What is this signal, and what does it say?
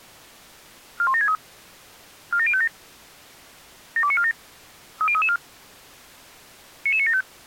Five-tone selective call (ZVEI), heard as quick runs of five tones, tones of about 70 ms. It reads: 41763 47057 72947 30334 99975